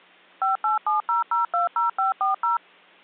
DTMF, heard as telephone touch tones, dialled by machine, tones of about 140 ms. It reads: 5870020540